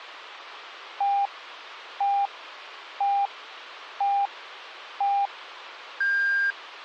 Radio time signal (five pips and a higher one, as on Chinese radio), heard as pips.